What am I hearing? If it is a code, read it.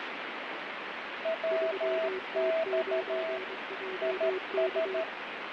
Morse code, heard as two keyed tones, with radio static and fading. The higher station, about 13 wpm, 650 Hz: WX IS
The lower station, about 23 wpm, 370 Hz: 3T9JK